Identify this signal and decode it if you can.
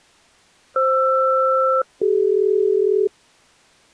Aircraft SELCAL, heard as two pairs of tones. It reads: FR-CD